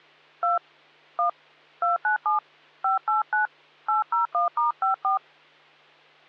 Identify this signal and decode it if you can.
DTMF, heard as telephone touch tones, dialled by hand, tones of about 130 ms, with hum. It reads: 2 1 297 589 801*54